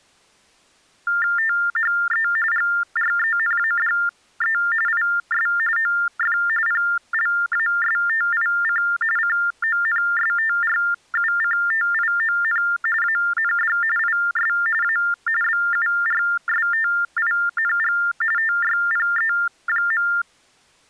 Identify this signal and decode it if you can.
TTY/TDD text telephone tones (45.45 baud Baudot), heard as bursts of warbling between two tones, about 400 Hz shift, 1600 Hz centre. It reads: THE GRENADE IS OF PLASTIC CONSTRUCTION AND IS A BURSTING TYPE.